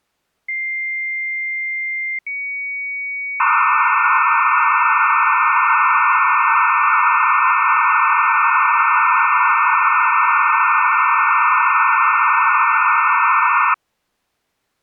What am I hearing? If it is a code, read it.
Dial-up modem handshake (low-speed, two carriers), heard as two whistles, then hiss.